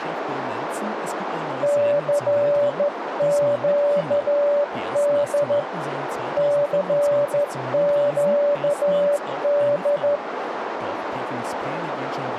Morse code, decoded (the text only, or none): CQD CQD